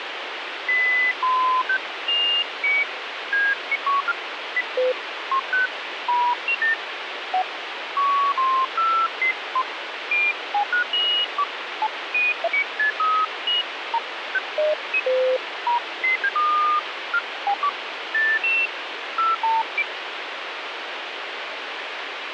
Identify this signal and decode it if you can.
Electronic bleeps of random pitch and length, with radio hiss. There is no code.